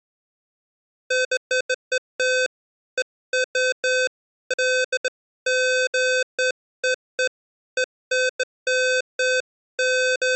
Beeps of irregular length. There is no code.